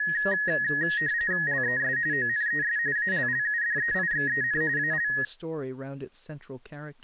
RTTY (45.45 baud, 170 Hz shift), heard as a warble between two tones, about 1800 Hz centre, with speech in English. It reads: LES ONES ALLUDEIXEN AL